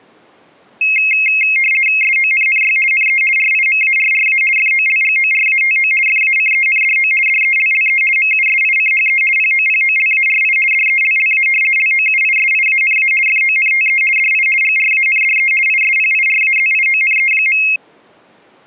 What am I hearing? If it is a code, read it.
RTTY (50 baud, 450 Hz shift), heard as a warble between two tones, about 2350 Hz centre. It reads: SONNY NE RIMARRA FOLGORATO FACENDO DELLE MUSICHE POPOLARI DELLA LOUISIANA FONTE DI GRANDE ISPIRAZIONE.